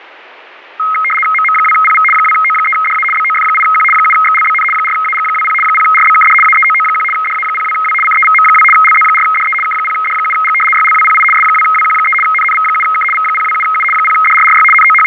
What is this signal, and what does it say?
RTTY (75 baud, 850 Hz shift), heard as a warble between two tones, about 1700 Hz centre, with radio static and fading. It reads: MM2PV 2O3DA BOF8Q 7XLBN 4AG20 0RBKD AEOO1 DA02W CEVM2 LZ4DE K0D7G YLWPI S2WQ3 NNV7K V027U 0DRRY …